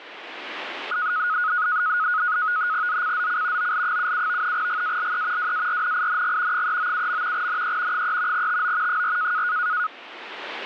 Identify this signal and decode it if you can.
NAVTEX (SITOR-B), 100 baud, 170 Hz shift, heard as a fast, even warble, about 1360 Hz centre, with radio static. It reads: ZCZC OL77 GALE WARNING 397. NE 3 TO 4